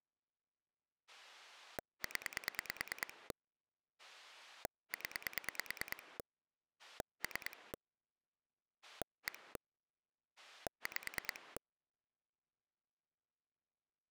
Pulse dialling, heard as a rotary dial, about 9 pulses a second. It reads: 0 0 3 1 5